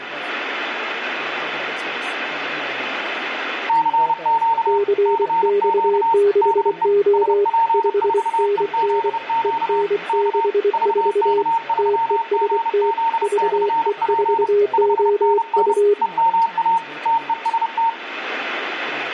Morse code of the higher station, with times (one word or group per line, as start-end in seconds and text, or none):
3.7-4.8 CQ
5.1-6.1 CQ
6.4-6.9 DE
7.1-9.8 SP4EZQ
10.1-10.5 K
10.7-14.5 VK3GZ/P
14.7-15.7 5NN
16.0-16.8 EMA
17.1-17.9 TEST